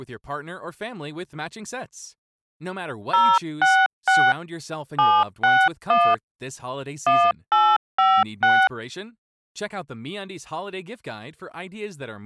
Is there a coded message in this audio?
Yes: DTMF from 3.1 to 8.7 s, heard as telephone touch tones, dialled by hand, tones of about 240 ms, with speech in Italian. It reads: 066 761 1856